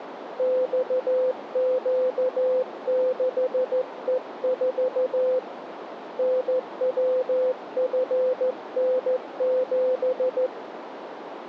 Morse code, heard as a keyed tone, hand-sent with a straight key, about 14 wpm, 510 Hz, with radio static and a narrow filter. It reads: XQ6E4 NWFN7